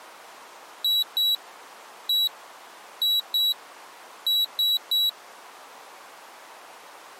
Beep code, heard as a piezo beeper, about 3900 Hz. 2-1-2-3. In Phoenix BIOS tables: ROM copyright notice check failure.